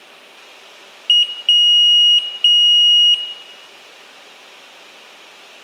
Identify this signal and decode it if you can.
Beep code, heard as a piezo beeper, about 2900 Hz, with room echo. 1 short, 2 long.